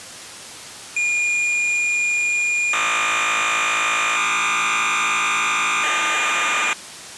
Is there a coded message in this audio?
Yes: cassette data (Kansas City type), 1200 baud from 1.0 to 6.7 s, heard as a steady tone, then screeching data.